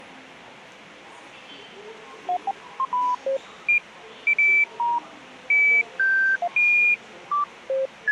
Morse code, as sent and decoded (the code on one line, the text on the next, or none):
none